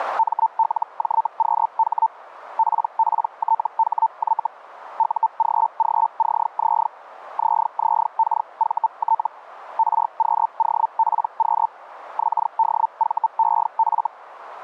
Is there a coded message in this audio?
Yes: Hellschreiber (Feld-Hell, 122.5 baud) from 0.2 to 14.1 s, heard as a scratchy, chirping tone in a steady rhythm, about 900 Hz. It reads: MLJQH PPTHY UGGCZ ZZKVT RQOPQ XDVEF